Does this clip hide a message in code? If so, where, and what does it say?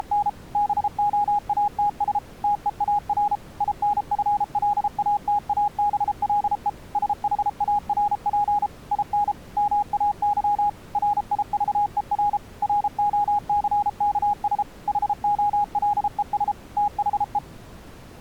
Yes: Morse code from 0.0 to 17.4 s, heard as a keyed tone, machine-sent, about 33 wpm, 820 Hz. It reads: … BOATS TEAR INFLATABLE SHARP IN MAY RIVER ROCKS HOLES THE